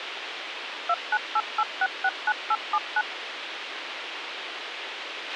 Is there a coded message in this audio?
Yes: DTMF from 0.9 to 3.0 s, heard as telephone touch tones, dialled by machine, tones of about 50 ms, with radio hiss and a squelch burst at the end. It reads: 2988669879